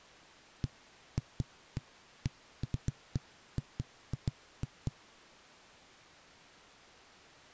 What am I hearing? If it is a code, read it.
Irregular knocks on a wall. There is no code.